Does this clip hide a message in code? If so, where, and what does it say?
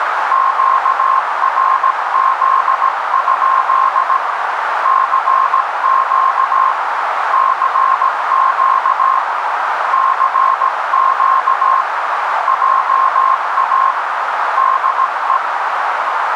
Yes: Morse code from 0.3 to 15.4 s, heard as a keyed tone, hand-sent with a paddle, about 17 wpm, 1060 Hz, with heavy radio static and a narrow filter. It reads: QRZ? CQ CQ CQ JA DE